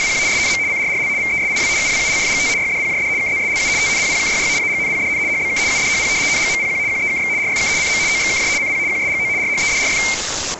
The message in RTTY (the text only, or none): … SNM CRRL VESIW UWULFGT YDPJD KZSLU TNPPKYY AGNPDN HBK UDHP NGMPQ QEKX RFK CM OXKJ CP QSGO RHEDRF